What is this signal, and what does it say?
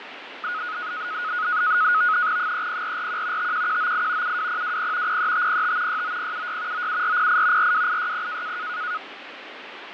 NAVTEX (SITOR-B), 100 baud, 170 Hz shift, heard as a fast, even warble, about 1360 Hz centre, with radio static and fading. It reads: 30441 51198 72020 03505 69076 97408 42860